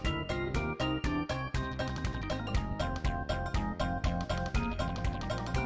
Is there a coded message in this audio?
No.